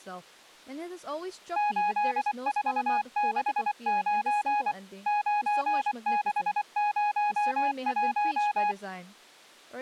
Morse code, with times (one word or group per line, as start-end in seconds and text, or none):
1.6-4.7 8469
5.1-8.7 9601